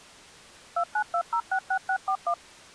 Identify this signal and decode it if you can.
DTMF, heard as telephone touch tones, dialled by machine, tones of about 80 ms. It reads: 292066641